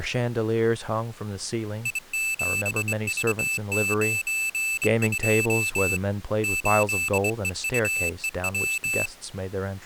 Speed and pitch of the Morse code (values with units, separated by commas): 23 wpm, 2650 Hz